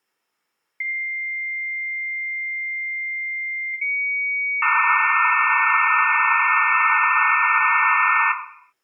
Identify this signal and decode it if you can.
Dial-up modem handshake (low-speed, two carriers), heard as two whistles, then hiss, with room echo.